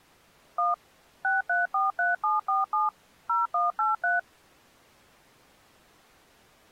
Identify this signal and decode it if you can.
DTMF, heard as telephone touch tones, dialled by machine, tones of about 160 ms. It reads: 1 6343747 0183